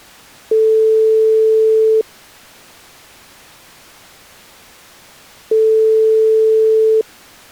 Telephone call progress tone (single-tone plan, as in most of Europe), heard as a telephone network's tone, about 440 Hz, 1.5 s on and 3.5 s off. Ringback tone.